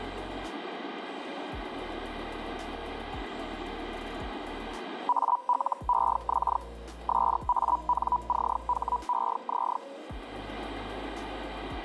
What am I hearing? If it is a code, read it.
Hellschreiber (Feld-Hell, 122.5 baud), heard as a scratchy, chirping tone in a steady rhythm, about 980 Hz. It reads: ALEX SANCHEZ